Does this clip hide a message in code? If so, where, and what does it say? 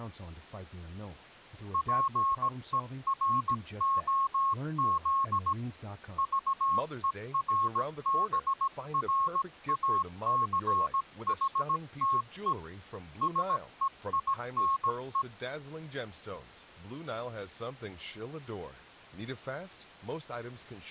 Yes: Morse code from 1.7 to 15.3 s, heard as a keyed tone, hand-sent with a paddle, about 17 wpm, 1090 Hz, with speech in English. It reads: PEROZ VERBRACHTE SEINE